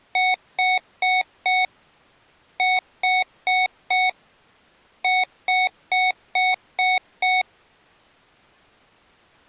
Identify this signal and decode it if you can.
Beep code, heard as beeps from a small speaker, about 740 Hz. 4-4-6.